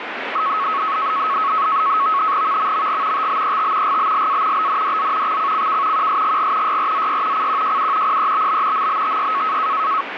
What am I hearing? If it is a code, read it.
NAVTEX (SITOR-B), 100 baud, 170 Hz shift, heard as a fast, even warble, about 1200 Hz centre, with radio static. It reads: VMMG TBET GBLA BNDZ XCCK QSGG YRZY CQJU PEBB MBTY